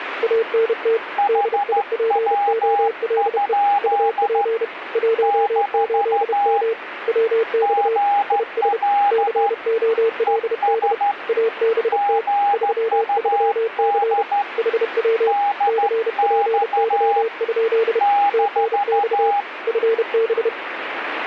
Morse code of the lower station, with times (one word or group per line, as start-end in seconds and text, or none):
0.2-1.0 ANT
1.3-3.5 DIPOLE
3.8-4.6 UP
5.0-6.7 18M
7.1-8.0 WX
8.3-8.8 IS
9.1-10.9 COLD
11.3-12.2 ABT
12.5-14.2 33C
14.6-15.3 HW
15.7-18.0 CPY?
18.3-19.3 TNX
19.7-20.5 FB